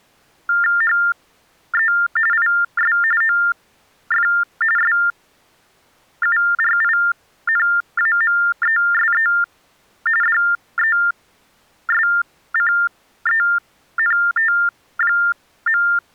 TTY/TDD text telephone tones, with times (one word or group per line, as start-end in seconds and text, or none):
0.8-1.9 HE
2.3-3.0 IS
3.2-4.3 OF
4.8-9.3 SURINAMESE
10.2-15.8 DESCENT.